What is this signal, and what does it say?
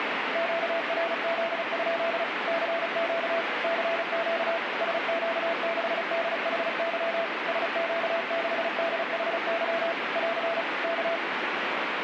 Morse code, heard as a keyed tone, machine-sent, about 35 wpm, 670 Hz, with radio static. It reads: QRZ? CQ CQ SQ6DHY SQ6DHY <AR> K